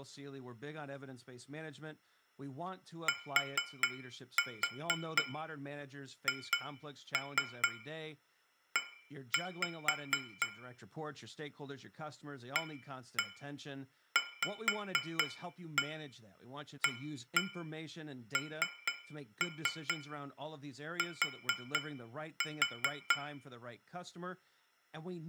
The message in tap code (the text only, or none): THE AVANT